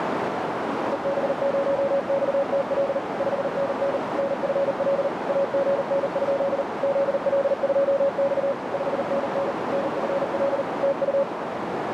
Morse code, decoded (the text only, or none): EB0XTL 5NN NFL AGN? ZL2X 5NN NFL TU